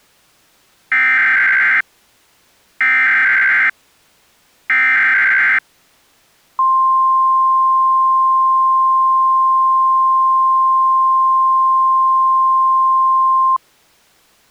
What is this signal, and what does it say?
Emergency Alert System (SAME) tones (header bursts, then the 1050 Hz attention tone), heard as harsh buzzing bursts, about 520.83 baud.